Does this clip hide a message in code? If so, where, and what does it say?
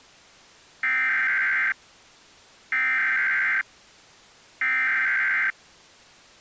Yes: Emergency Alert System (SAME) tones (header bursts) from 0.8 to 5.5 s, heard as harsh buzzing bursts, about 520.83 baud.